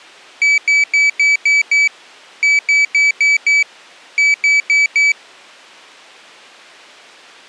Beep code, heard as a piezo beeper, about 2300 Hz. 6-5-4.